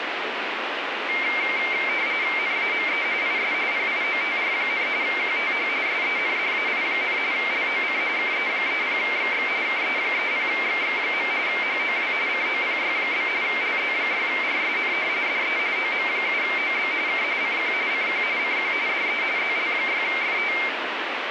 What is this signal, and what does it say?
RTTY (45.45 baud, 170 Hz shift), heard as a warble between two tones, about 2200 Hz centre, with radio static. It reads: NAME IS PIOTR, QTH SENDAI, LOC KE30XX KE30XX. HOW COPY? LZ6RSN DE OM7OB K CQ CQ CQ DE ZL6FT